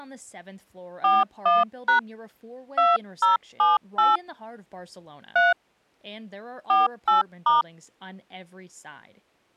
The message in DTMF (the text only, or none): 41# 2078 3 48*